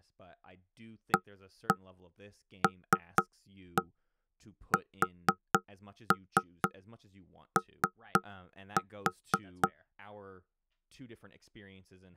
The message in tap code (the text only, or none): ALSO